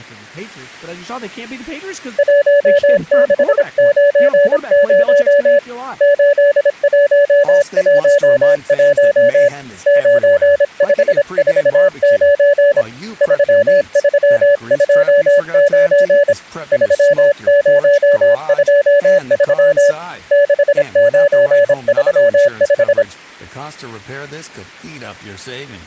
Morse code, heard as a keyed tone, hand-sent with a paddle, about 26 wpm, 570 Hz, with speech in English. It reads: 1690 8111 9549 3329 3023 6935